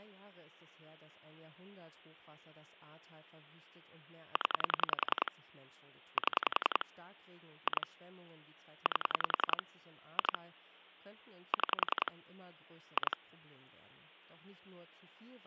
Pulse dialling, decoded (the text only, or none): 0 7 2 8 2 6 2